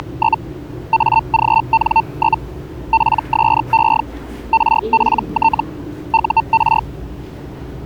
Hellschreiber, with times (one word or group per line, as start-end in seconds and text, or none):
0.0-0.4 …
0.9-2.4 AGN?
2.9-4.0 PSE
4.5-5.6 RPT
6.1-6.8 UR